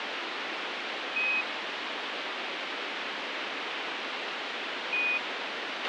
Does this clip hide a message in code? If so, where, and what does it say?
Yes: Quindar tones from 1.2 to 5.2 s, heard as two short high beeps, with radio hiss and a squelch burst at the end.